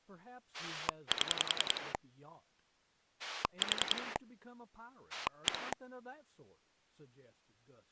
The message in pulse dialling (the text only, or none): 7 4 1